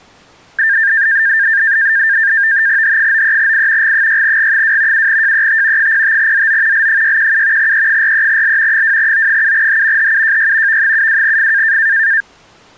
NAVTEX (SITOR-B), 100 baud, 170 Hz shift, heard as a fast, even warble, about 1700 Hz centre. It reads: H93I G6G2 7JET 05ZO L617 E43L 2O7H HUJY V72F